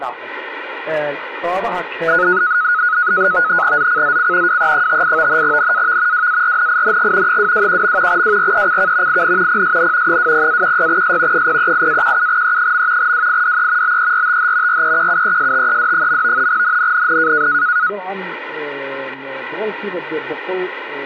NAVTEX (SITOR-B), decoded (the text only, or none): ZCZC WE58 NAV WARNING 221. WRECK IN PSN 20-16S 038-17E. WIDE BERTH REQUESTED. NNNN